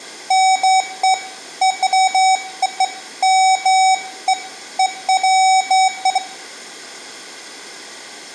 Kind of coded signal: none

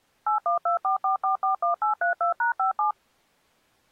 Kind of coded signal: DTMF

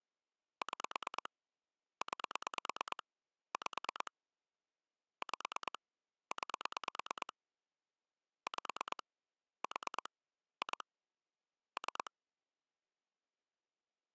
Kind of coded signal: pulse dialling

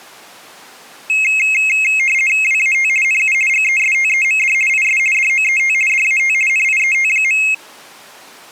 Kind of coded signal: RTTY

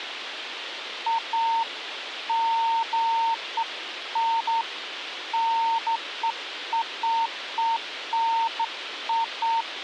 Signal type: none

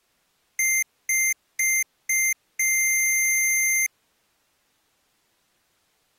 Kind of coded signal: beep code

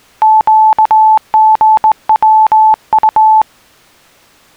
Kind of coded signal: Morse code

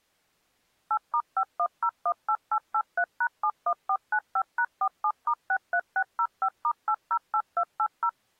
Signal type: DTMF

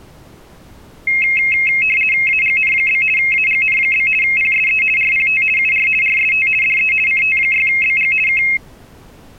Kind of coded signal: RTTY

